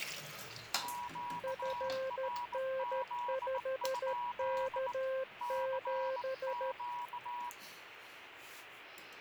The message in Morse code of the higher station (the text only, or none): QRZ? CQ